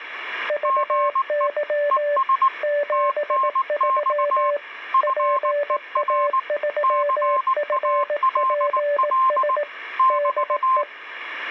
Morse code, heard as two keyed tones. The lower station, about 18 wpm, 580 Hz: VY 73 PA3FPS DE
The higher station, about 19 wpm, 1060 Hz: GE ES TNX FER CALL <BT>